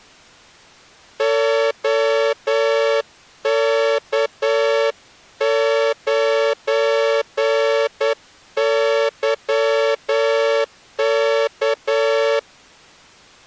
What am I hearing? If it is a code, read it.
Morse code, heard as a horn, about 9 wpm. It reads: OK9YK